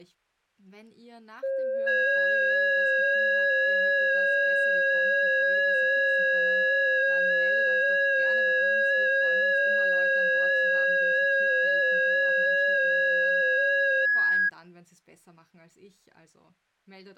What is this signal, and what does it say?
FT8 (several signals at once), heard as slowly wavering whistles, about 6.25 baud.